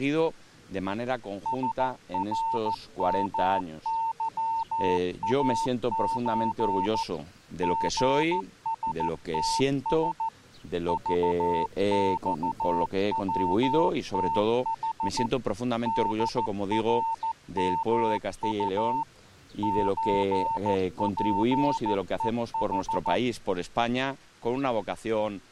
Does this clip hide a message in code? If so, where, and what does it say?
Yes: Morse code (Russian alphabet) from 1.4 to 23.2 s, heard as a keyed tone, machine-sent, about 14 wpm, 900 Hz. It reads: СРМЫАЧ ГСТС ЖЬВТХ ДРМУ ЧПЕХ